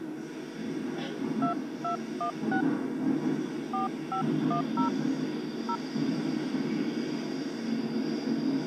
DTMF, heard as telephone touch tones, dialled by hand, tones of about 100 ms, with the noise inside a subway train. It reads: 2216 4510 0